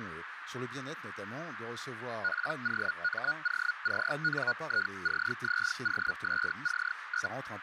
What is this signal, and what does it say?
Hellschreiber (Feld-Hell, 122.5 baud), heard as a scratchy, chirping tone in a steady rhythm, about 1450 Hz, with radio static and a narrow filter. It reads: POMOCNICZOSC?